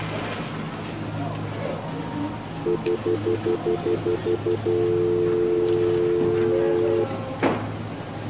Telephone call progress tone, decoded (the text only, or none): stutter dial tone